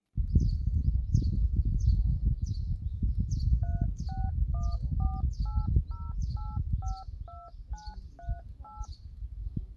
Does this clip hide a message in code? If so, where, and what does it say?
Yes: DTMF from 3.6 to 8.9 s, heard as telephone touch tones, dialled by machine, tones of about 210 ms, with the noise of a park. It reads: 361480852938